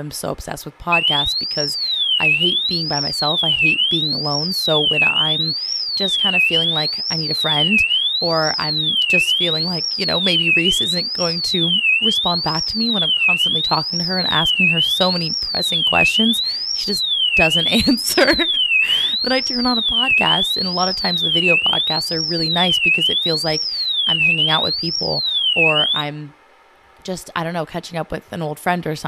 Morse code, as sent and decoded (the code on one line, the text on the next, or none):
none